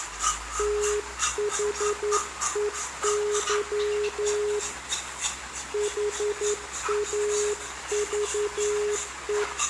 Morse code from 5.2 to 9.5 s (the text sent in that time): HAVE